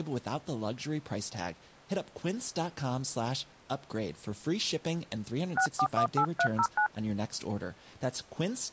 DTMF, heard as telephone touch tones, dialled by hand, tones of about 80 ms, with speech in French. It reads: 6418309